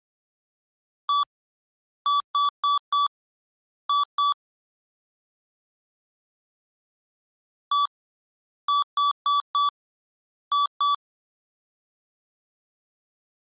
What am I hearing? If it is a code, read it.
Beep code, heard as beeps from a small speaker, played twice, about 1150 Hz. 1-4-2. In Phoenix BIOS tables: parity failure in the first 64 KB of memory.